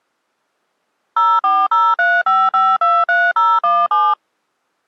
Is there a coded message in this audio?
Yes: DTMF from 1.2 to 4.1 s, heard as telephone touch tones, dialled by machine, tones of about 230 ms. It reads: 04035523017